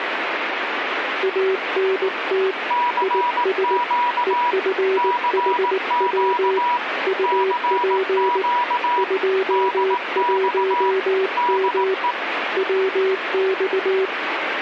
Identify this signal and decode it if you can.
Morse code, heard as two keyed tones, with radio static. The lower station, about 19 wpm, 380 Hz: ANT IS EFHW UP 21M WX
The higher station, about 18 wpm, 970 Hz: CQ CQ CQ DX DE